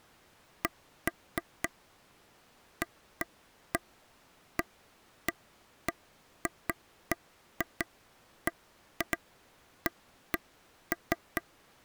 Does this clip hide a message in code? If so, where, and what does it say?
No, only irregular taps on a table.